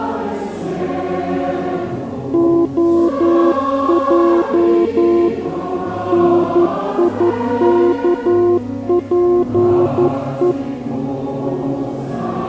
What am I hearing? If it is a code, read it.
Morse code, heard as a keyed tone, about 11 wpm, 350 Hz. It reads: OJ NIKPE